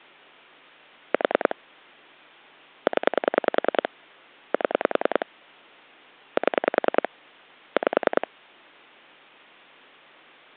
Pulse dialling, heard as clicks on a phone line, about 10 pulses a second. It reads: 4 0 7 7 5